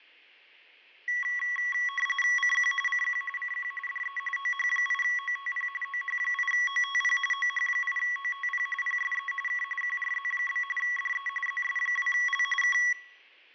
RTTY (45.45 baud, 850 Hz shift), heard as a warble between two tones, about 1550 Hz centre, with fading. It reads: CQ CQ CQ DE OH8OTP OH8OTP OH8OTP PSE K QRZ? DE ZS2L K